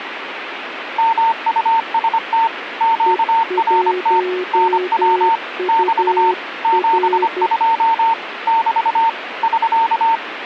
Morse code, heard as two keyed tones, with radio static. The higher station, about 25 wpm, 910 Hz: MUST QRT NW <BT> 72 <BT> <SK>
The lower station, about 12 wpm, 360 Hz: E1UR